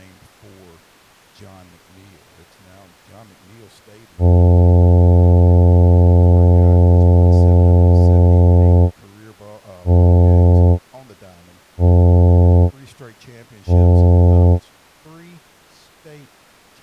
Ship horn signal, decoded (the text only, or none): 1 long, 3 short